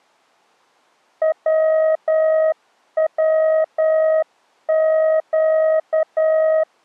Morse code (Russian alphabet), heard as a keyed tone, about 10 wpm, 630 Hz. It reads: ВВЩ